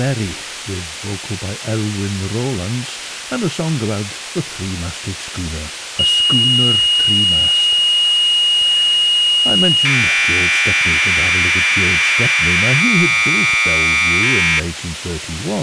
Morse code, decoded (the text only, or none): none